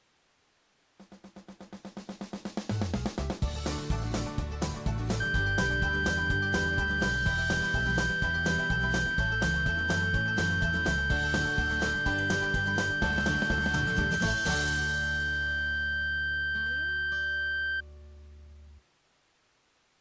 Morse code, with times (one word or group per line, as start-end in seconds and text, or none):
none